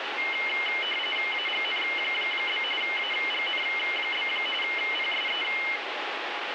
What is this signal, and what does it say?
RTTY (45.45 baud, 850 Hz shift), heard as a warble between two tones, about 2550 Hz centre, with radio static. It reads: AGN? AGN? PSE